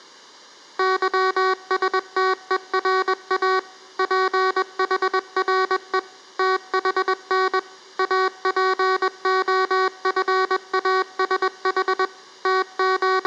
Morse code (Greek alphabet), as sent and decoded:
-.-- ... - . .-. .- / .--. .... .-. . / - .... -. / .- .--. --- ..-. .- ... .... / …
ΥΣΤΕΡΑ ΠΗΡΕ ΤΗΝ ΑΠΟΦΑΣΗ …

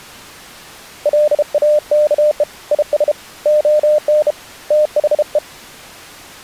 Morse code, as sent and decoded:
.-.. .- -.- . / .. ... / --- -. / - .... .
LAKE IS ON THE

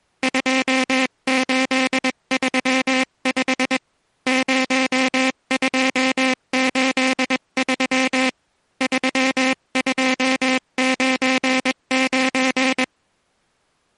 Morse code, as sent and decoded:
..--- ---.. ...-- ..... / ----- ..--- ---.. ...-- / ...-- ..--- ----. ----.
2835 0283 3299

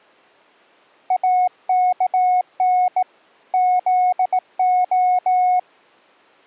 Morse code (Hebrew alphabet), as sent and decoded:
.- -.- -. / --.. ---
אכן זה

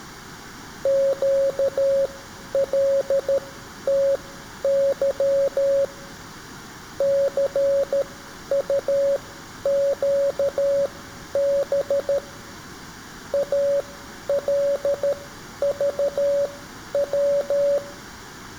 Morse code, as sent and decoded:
--.- .-.. - -.-- / -.-. ..- --.- -... / .- .-.. ...- .--
QLTY CUQB ALVW

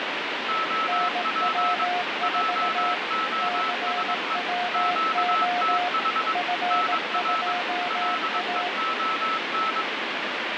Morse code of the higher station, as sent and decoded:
--- .--. / .--- --- ... . / --.- - .... / -. .-. / .-.. . --- -.
OP JOSE QTH NR LEON

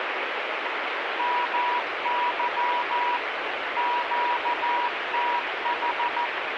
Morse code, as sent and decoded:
-- -.-- / --.- - ....
MY QTH

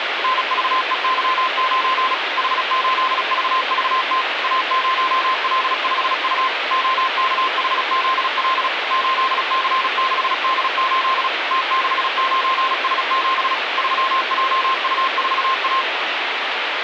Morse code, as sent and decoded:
-. ...- . -.-- ----. / .... ---.. ...- ...- - / .- ----- .-.. ..... ..- / --- -.- .... --.. .-.. / ---.. -.-. -.... -.. ---.. / - -.... ----. ... --... / ...-- .--- ..- ....- .-
NVEY9 H8VVT A0L5U OKHZL 8C6D8 T69S7 3JU4A

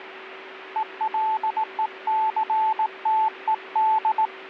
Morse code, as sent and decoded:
. .-.. . -.-. - . -..
ELECTED

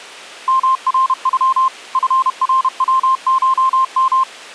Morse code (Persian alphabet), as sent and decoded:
-- .-. ..-- / ..-. .-. .-- ---- --
مرغ فروشم

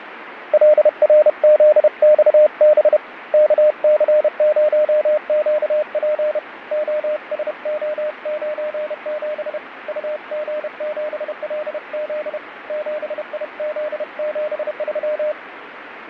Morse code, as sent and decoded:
.-.. .-. --.. -..- -... / -.- -.-. ----- --.- .--. / --- ... --- ----. --... / ..- --. --... .-.. --.. / --... .. --.. --... ...--
LRZXB KC0QP OSO97 UG7LZ 7IZ73

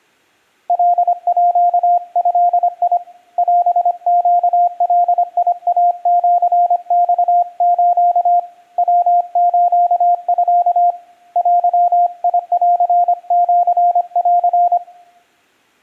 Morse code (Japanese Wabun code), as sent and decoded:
.-.. .--.- ..-.. .. / .-... --.- .-.. .. .- --.-. -..- ---.- / .-- ---.- ..-.- / .-.-- .. .-.-. --.-. .-.-.
カード オネガイシマス ヤスミ デンシン

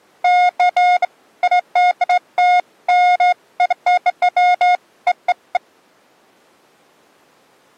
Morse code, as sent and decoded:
none

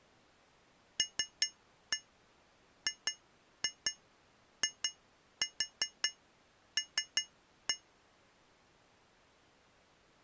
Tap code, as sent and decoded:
3-1 2-2 2-4 3-1
LGIL

